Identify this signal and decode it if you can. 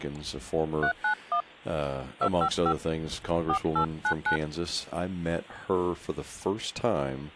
DTMF, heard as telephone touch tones, dialled by hand, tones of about 90 ms, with speech in English. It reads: 391 255 4899